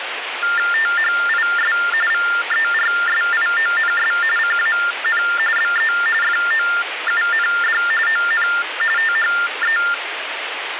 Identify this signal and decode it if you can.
TTY/TDD text telephone tones (45.45 baud Baudot), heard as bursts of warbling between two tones, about 400 Hz shift, 1600 Hz centre, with phone line noise. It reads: THIS VERSIONS CAN BE FOUND ON THE